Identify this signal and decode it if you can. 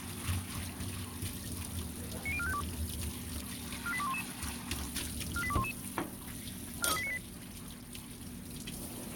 Five-tone selective call (ZVEI), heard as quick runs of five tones, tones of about 70 ms, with a squelch burst at the end and kitchen noise. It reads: 90452 48211 48211 43898